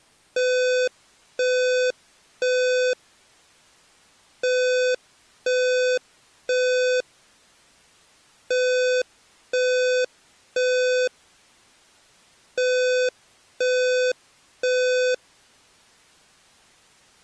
Alarm pattern, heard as an alarm's beeps, played four times, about 500 Hz. Temporal three. Smoke or fire, evacuate.